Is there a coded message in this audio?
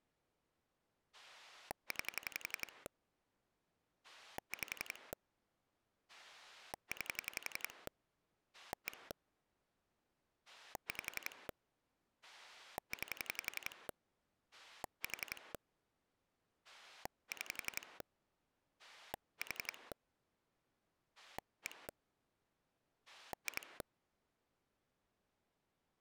Yes: pulse dialling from 1.1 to 23.8 s, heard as a rotary dial, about 11 pulses a second. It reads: 9 5 9 1 5 9 4 6 4 1 2